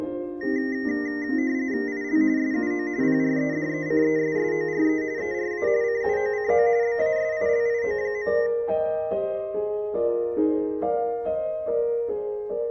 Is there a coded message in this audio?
Yes: RTTY (45.45 baud, 170 Hz shift) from 0.4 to 8.5 s, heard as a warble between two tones, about 1950 Hz centre. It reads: IL SUO PREDECESSORE ERA CUOCO BASILIO.